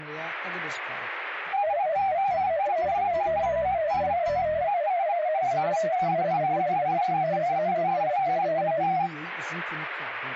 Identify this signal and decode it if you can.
Multi-tone FSK (Olivia or MFSK type), about 250 Hz wide, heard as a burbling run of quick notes, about 31.25 baud.